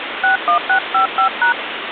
DTMF, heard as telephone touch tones, dialled by hand, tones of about 100 ms, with phone line noise. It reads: 61655#